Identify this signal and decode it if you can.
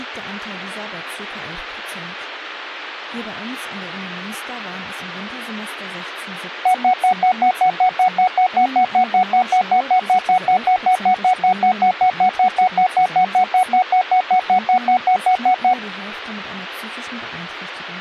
Evenly repeated beeps, with speech in German. There is no code.